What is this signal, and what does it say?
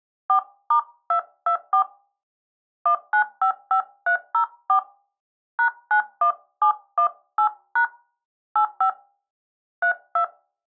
DTMF, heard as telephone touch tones, dialled by hand, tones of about 90 ms. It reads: 4*224 1955304 #91718# 85 32